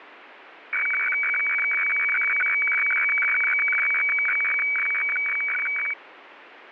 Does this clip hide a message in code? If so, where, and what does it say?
Yes: weather fax (radiofax), 120 lines a minute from 0.7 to 5.9 s, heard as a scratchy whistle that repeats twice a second, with radio static.